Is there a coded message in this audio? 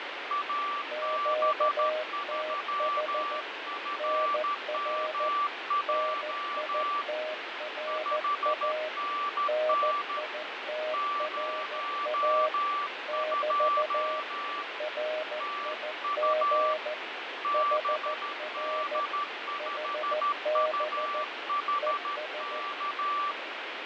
Yes: Morse code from 0.2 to 23.4 s, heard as two keyed tones, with heavy radio static and fading. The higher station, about 13 wpm, 1160 Hz: AB3FMJ 5NN 02 TU BD5UHK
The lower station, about 14 wpm, 620 Hz: QTH NR NITRA NITRA <BT> RIG HR HB ES